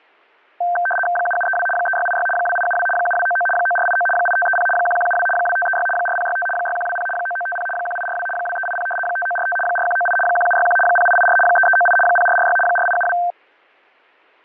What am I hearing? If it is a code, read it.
RTTY (75 baud, 850 Hz shift), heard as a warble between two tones, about 1130 Hz centre, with fading. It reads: 7732 3686 2872 7299 9489 8530 1172 2536 4065 6120 9950 1842 2380 5945 4198 1761 0884 3398 0446 4872